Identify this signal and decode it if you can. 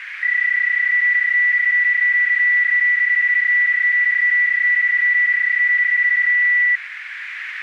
PSK31 (31.25 baud), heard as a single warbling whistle, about 1950 Hz, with radio static and a narrow filter.